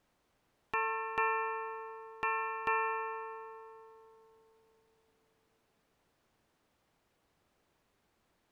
Ship's bell, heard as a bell. 4. Four half-hours of the watch have passed.